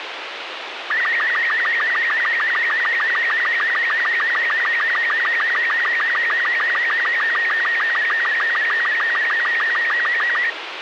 SSTV (slow-scan television), Robot 36, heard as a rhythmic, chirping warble, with radio hiss.